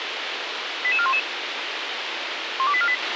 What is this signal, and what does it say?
Five-tone selective call (ZVEI), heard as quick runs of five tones, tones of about 70 ms, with radio hiss and a squelch burst at the end. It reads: 88411 12848